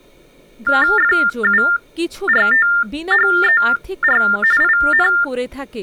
TTY/TDD text telephone tones (45.45 baud Baudot), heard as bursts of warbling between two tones, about 400 Hz shift, 1600 Hz centre, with speech in Bangla. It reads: FURTHER IN